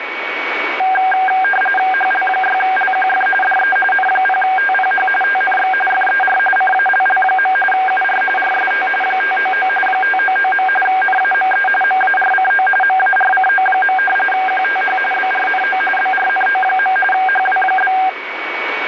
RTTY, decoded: HL6LQF DE N0TPH TNX FER CALL. UR RST 599 599. NAME MARCO MARCO. QTH BRNO BRNO. HW?

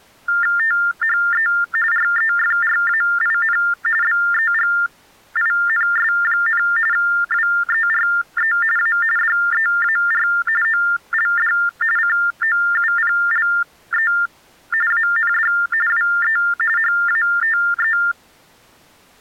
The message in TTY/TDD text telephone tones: THE REFRAIN BEGINS, WERE A DEAR OLD COUPLE AND WE HATE

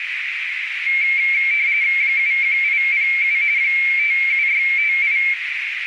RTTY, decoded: 71807 57658

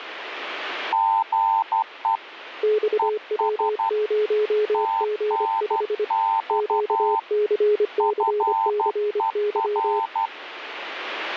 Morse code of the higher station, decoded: GE ES TNX FER

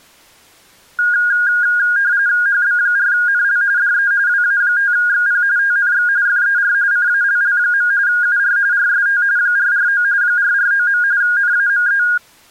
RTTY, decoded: HB4NL DE WA5XP TNX FER CALL. UR RST 449 449. NAME

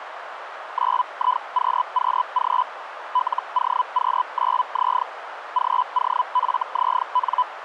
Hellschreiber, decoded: 9IQQG LOQ9Z GOFZN

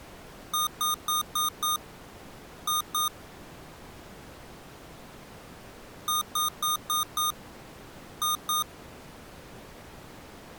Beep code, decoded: 5-2

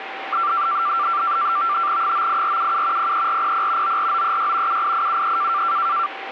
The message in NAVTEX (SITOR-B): 98477 03400 94936 78873

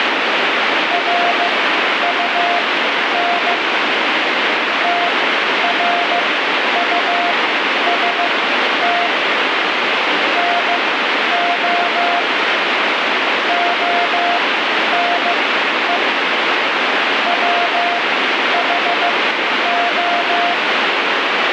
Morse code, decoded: RUN TRUST NO ONE WHO

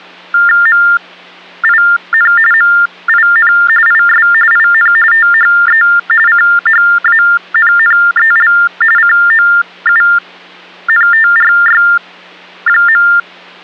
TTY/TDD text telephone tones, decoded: MIN MIN IS IN THE CHANNEL COUNTRY.

